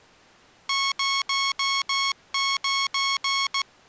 Morse code, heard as electronic beeps, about 16 wpm, 1100 Hz. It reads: 09